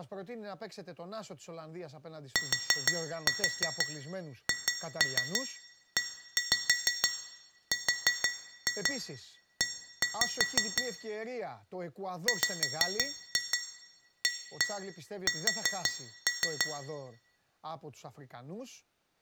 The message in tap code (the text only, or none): THERE WAS